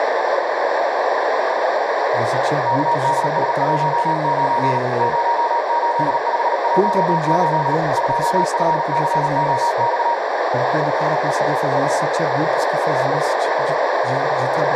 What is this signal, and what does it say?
Morse code, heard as a keyed tone, machine-sent, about 38 wpm, 940 Hz, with heavy radio static, a narrow filter and speech in Portuguese. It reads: KDS19 08518 2FCOX